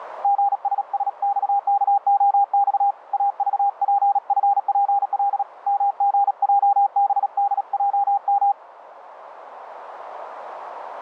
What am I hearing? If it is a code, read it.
Morse code, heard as a keyed tone, hand-sent with a paddle, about 37 wpm, 800 Hz, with radio static. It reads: GSSXKOX AVPFPL MGJBDJM